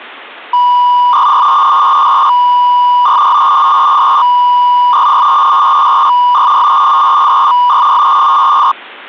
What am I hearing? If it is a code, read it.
300-baud modem data (V.21 tones), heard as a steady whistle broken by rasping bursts, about 300 baud, 200 Hz shift.